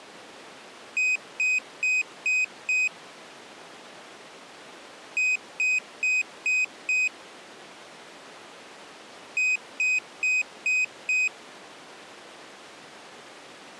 Beep code, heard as a piezo beeper, played three times, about 2500 Hz. 5 short. In AMI BIOS tables: processor failure; in Dell tables: CMOS battery failure.